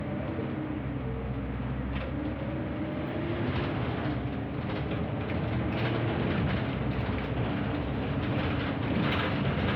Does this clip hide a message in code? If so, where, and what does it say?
No, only the noise inside a bus.